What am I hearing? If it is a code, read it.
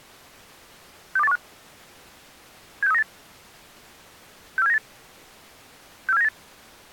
Five-tone selective call (EEA), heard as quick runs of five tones, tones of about 40 ms. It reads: 62815 76398 64798 64798